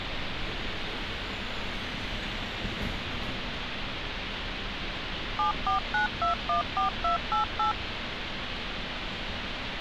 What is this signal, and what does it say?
DTMF, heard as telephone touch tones, dialled by machine, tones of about 120 ms, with phone line noise and street noise. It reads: 749214288